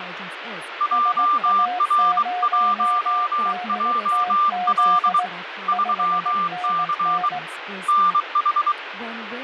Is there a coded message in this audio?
Yes: Morse code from 0.7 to 8.8 s, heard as two keyed tones, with radio static and speech in English. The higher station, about 23 wpm, 1190 Hz: JR1JL 3C NH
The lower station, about 18 wpm, 720 Hz: SA0DTZ 5NN